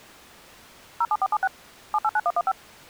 DTMF, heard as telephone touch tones, dialled by machine, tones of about 50 ms. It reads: 07476 789115